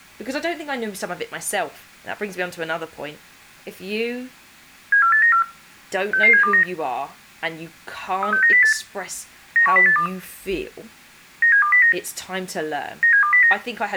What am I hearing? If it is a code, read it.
Five-tone selective call (CCIR), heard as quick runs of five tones, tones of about 100 ms, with room echo and speech in English. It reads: 74894 66729 36908 91082 97209 97209